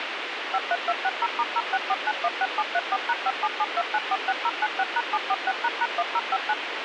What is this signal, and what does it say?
DTMF, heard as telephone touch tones, dialled by machine, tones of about 50 ms, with radio hiss and a squelch burst at the end. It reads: 53260*064916734#5772946096#746##1059